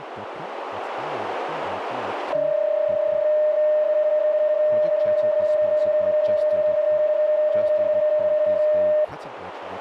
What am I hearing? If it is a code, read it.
PSK31 (31.25 baud), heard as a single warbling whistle, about 610 Hz, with radio static and speech in English.